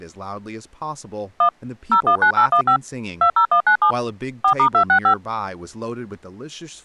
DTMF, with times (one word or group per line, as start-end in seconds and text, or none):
1.4-1.5 1
1.9-2.8 019815
3.2-3.9 20197
4.4-5.1 4*265